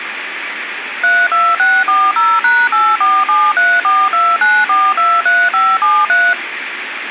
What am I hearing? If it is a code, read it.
DTMF, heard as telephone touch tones, dialled by machine, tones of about 230 ms, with phone line noise. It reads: 32640#8473429423573